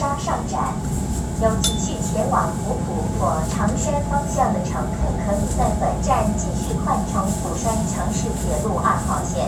The noise inside a subway train. There is no code.